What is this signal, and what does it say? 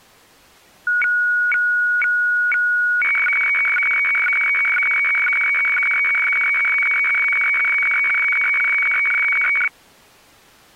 Weather fax (radiofax), 120 lines a minute, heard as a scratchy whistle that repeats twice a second.